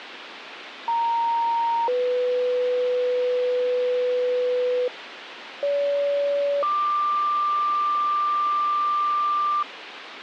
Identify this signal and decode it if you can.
Two-tone page, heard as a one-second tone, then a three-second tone, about 930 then 500 Hz, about 570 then 1180 Hz, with radio hiss.